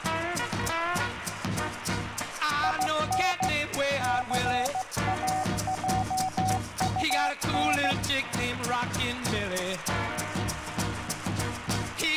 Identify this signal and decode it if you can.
Morse code, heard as a keyed tone, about 16 wpm, 750 Hz, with radio static. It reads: IN CAJUN